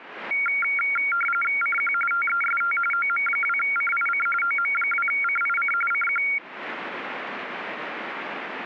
RTTY (45.45 baud, 850 Hz shift), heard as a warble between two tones, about 1800 Hz centre. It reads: CQ TEST OM2CIC OM2CIC CQ